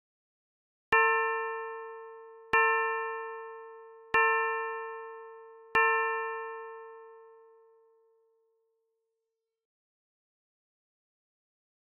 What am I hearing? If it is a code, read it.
Clock strike, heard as a bell. 4. Four o'clock.